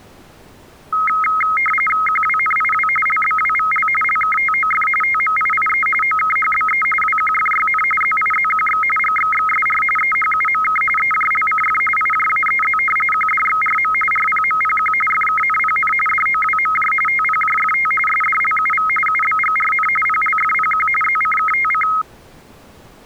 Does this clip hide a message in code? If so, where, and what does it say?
Yes: RTTY (45.45 baud, 850 Hz shift) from 0.9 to 22.0 s, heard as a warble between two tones, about 1700 Hz centre. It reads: QWNIW LBWVL LKTOF TMIIE OKHBE WQFYN ZIZQX GXXSR EHUMK EJLCF IJAEZ QDXRM RPMPQ FKNPN DOWMJ TPJFT SDLUV UBGRN PLFPQ ZCKTC